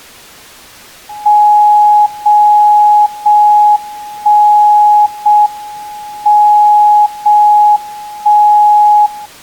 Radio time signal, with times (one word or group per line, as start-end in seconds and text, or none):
1.3-2.3 0
2.3-3.3 0
3.3-4.3 1
4.3-5.3 0
5.3-6.3 M
6.3-7.3 0
7.3-8.3 1
8.3-9.3 0